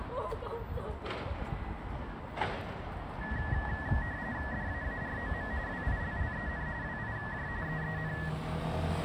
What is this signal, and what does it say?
RTTY (45.45 baud, 170 Hz shift), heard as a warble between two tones, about 1800 Hz centre, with street noise. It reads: DAAROM WILLEN WIJ EEN